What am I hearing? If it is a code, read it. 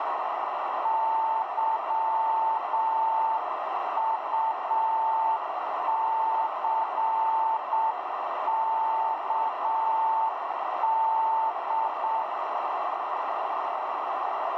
Morse code, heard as a keyed tone, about 7 wpm, 890 Hz, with heavy radio static and a narrow filter. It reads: YUCKD